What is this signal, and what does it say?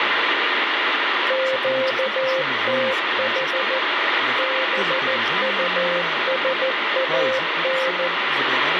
Morse code, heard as a keyed tone, machine-sent, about 14 wpm, 530 Hz, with heavy radio static and speech in Bulgarian. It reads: QTH BUSAN